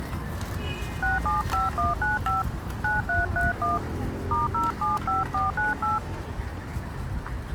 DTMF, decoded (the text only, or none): 675195 9331 *075498